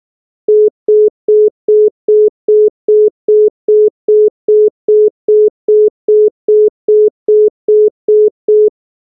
Telephone call progress tone (single-tone plan, as in most of Europe), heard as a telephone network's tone, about 420 Hz, 0.2 s on and 0.2 s off. Congestion tone.